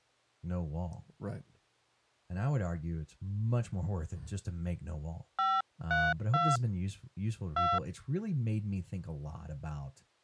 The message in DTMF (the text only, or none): 532 2